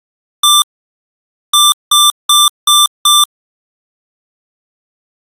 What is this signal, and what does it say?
Beep code, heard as beeps from a small speaker, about 1180 Hz. 1-5.